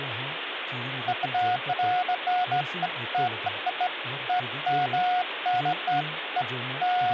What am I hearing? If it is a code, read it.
Beeps of irregular length, with phone line noise and speech in Santali. There is no code.